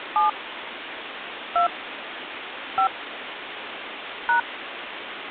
DTMF, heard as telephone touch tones, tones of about 130 ms, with phone line noise. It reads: 7 2 5 #